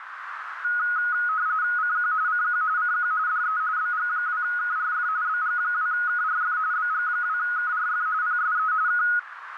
RTTY (45.45 baud, 170 Hz shift), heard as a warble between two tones, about 1360 Hz centre, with radio static and a narrow filter. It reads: CQ CQ CQ DE BG2KRF BG2KRF BG2KRF PSE K